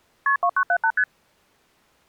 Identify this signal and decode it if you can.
Multi-frequency trunk signalling (R1, as on North American trunks), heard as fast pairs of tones, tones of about 70 ms. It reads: KP 2978 ST